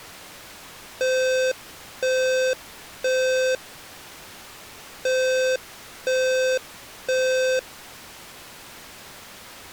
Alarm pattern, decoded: temporal three

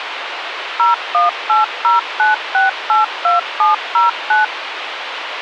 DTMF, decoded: 01809682709

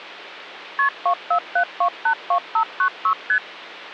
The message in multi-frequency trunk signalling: KP 247282596 ST

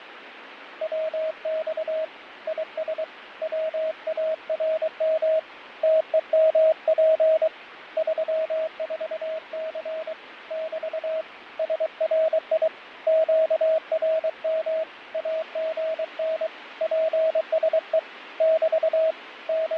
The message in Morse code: WX IS WARM TEMP 34C <BT> SRI QRM AGN PSE <BT> …

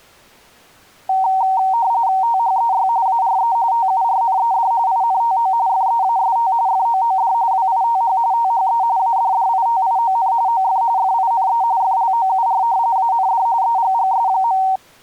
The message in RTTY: THEY ARE TURNED INTO FEAST FOOD WITH THE ADDITION OF FINE FLOUR AND EGGS.

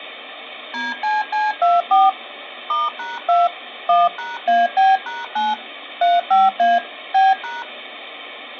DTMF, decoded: DCC24 *#2 1#AB#9 35A B#

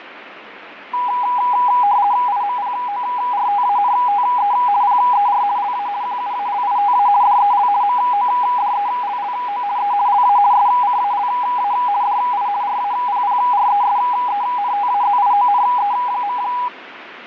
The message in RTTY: IMPORTANTE PER LA QUALITA DEL MODELLO E LA SCALA DI RAPPRESENTAZIONE.

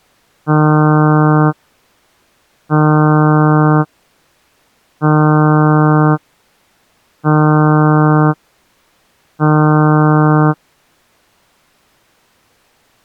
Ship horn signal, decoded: 5 short

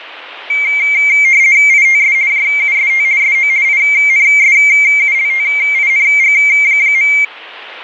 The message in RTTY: ITS JUST SO INSULTING.

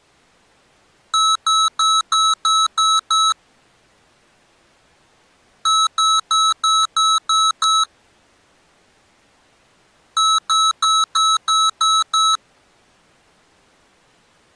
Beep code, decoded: 7 short

